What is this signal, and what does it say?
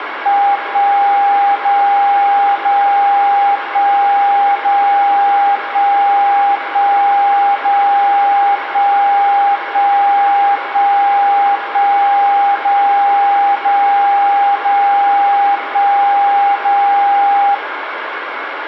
Radio time signal (DCF77), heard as a tone whose level steps once a second, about 800 Hz, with radio static. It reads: 1 0 0 1 0 1 1 0 1 1 1 1 0 0 0 1 0